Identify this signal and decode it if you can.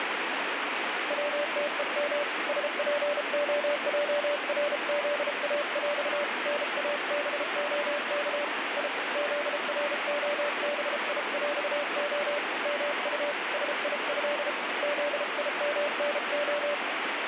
Morse code (with Polish letters), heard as a keyed tone, hand-sent with a paddle, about 33 wpm, 580 Hz, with heavy radio static. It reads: WTEM SPOJRZAŁ NABOK I ZROBIŁO MU SIĘ ZIMNO